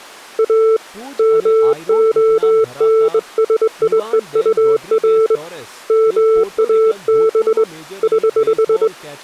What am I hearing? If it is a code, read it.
Morse code, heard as a keyed tone, hand-sent with a straight key, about 21 wpm, 440 Hz, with speech in Gujarati. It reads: A MONSIEUR MAB <HH>